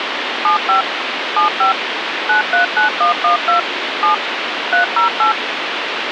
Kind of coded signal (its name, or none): DTMF